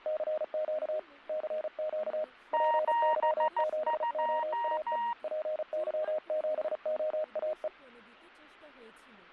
Morse code, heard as two keyed tones, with static crashes and speech in Bangla. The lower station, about 35 wpm, 620 Hz: CQ CQ PY7OAE PY7OAE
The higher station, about 14 wpm, 940 Hz: 72